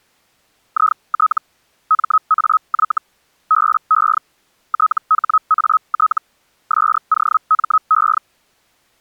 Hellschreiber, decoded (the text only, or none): IT MAY BE THAT SOME